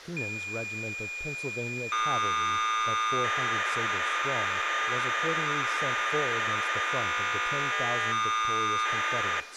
Cassette data (Kansas City type), 1200 baud, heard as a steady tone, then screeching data, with speech in English.